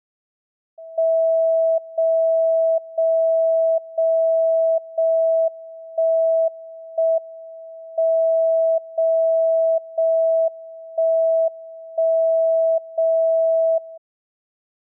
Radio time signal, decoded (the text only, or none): 0 0 0 0 1 1 M 0 0 1 1 0 0